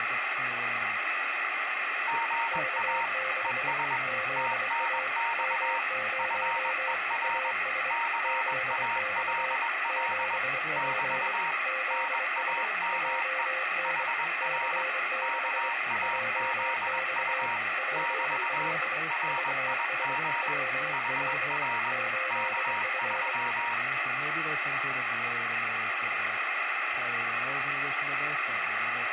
Morse code, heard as two keyed tones, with radio static and speech in English. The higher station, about 21 wpm, 930 Hz: GA ES TNX FER CALL <BT> NAME HR KAZU <BT> RIG HR K3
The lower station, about 24 wpm, 520 Hz: K6 ZA M0 AS ZX 7P ZS JN C6 JX PL VS WR 8F